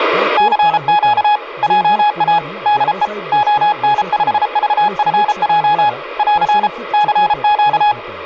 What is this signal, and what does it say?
Morse code, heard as a keyed tone, hand-sent with a paddle, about 33 wpm, 840 Hz, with speech in Marathi. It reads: CQ JA DE ON5VFJ <AR> CQ